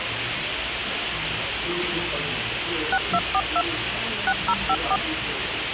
DTMF, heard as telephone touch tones, dialled by machine, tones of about 60 ms, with radio hiss, a squelch burst at the end and the noise of a cafe. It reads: 6242 6054